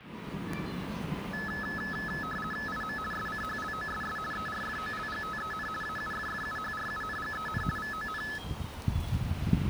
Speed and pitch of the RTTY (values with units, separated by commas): 50 baud, 450 Hz shift, 1500 Hz centre